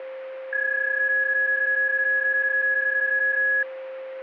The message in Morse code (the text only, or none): none